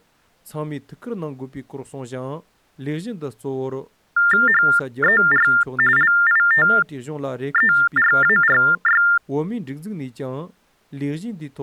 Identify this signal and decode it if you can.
TTY/TDD text telephone tones (45.45 baud Baudot), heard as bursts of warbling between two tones, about 400 Hz shift, 1600 Hz centre. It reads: HER LITERARY